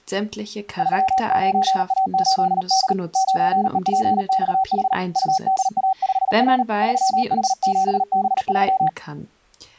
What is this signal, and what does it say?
Morse code, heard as a keyed tone, hand-sent with a paddle, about 38 wpm, 760 Hz, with speech in German. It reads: 39A8D 9EPXH UDA5R 3H7B3